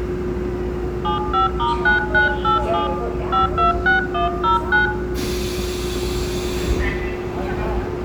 DTMF, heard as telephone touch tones, dialled by hand, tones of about 140 ms, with room echo and the noise inside a subway train. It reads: 75*9987 526109